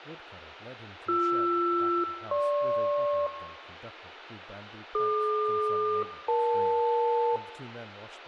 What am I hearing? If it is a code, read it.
Aircraft SELCAL, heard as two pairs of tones, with radio hiss, room echo and speech in English. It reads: BR-GP DQ-EL